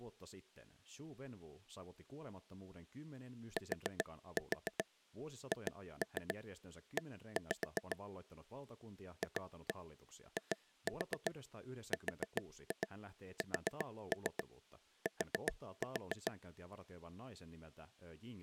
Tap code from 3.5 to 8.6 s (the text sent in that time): THE